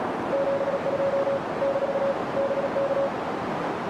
Morse code, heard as a keyed tone, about 37 wpm, 550 Hz, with radio static and a narrow filter. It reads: 72 - BK